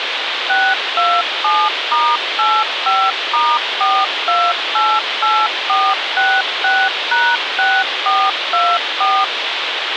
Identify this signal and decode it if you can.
DTMF, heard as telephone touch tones, dialled by machine, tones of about 240 ms, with radio hiss. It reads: 627*85*4288466#6424